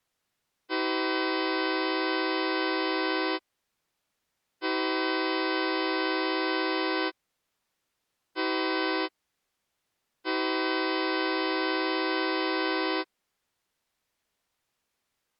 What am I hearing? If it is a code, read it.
Train horn signal, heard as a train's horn. 2 long, 1 short, 1 long. On North American railways: approaching a public crossing.